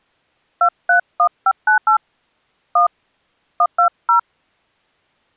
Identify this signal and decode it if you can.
DTMF, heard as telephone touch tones, dialled by hand, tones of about 90 ms. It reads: 231598 1 120